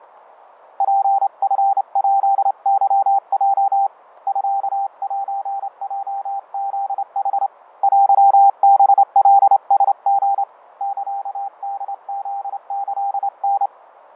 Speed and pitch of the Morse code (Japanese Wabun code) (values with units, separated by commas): 28 wpm, 790 Hz